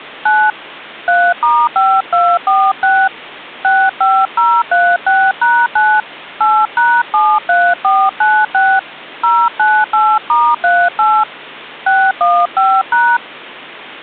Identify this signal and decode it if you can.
DTMF, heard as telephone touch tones, dialled by hand, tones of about 250 ms. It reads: 9 3*5246 65036#9 8#73496 098*38 615#